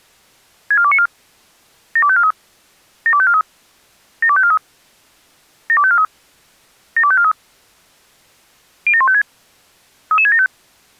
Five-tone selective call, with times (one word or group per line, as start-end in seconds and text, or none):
0.7-1.1 64294
2.0-2.3 72543
3.1-3.4 72543
4.2-4.6 72543
5.7-6.0 72543
7.0-7.3 72543
8.9-9.2 07156
10.1-10.5 33675